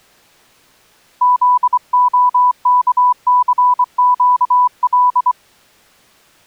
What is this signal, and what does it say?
Morse code, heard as a keyed tone, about 24 wpm, 990 Hz. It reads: ZOKCQL